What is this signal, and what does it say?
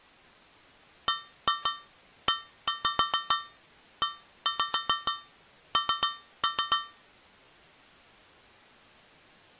Tap code, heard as taps on a metal pipe, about 6 knocks a second. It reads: BEEN